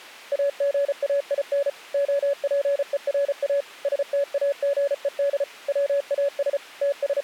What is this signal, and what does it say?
Morse code, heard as a keyed tone, machine-sent, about 34 wpm, 560 Hz. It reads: AGAIN OPERA STAGED WAS …